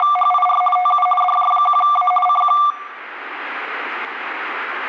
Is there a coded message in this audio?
Yes: RTTY (50 baud, 450 Hz shift) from 0.0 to 2.7 s, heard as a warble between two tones, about 950 Hz centre, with room echo. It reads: … TU DJ1A CQ